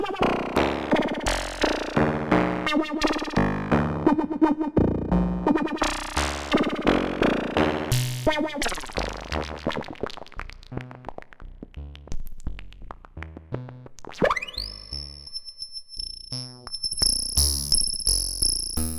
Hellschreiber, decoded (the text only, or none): none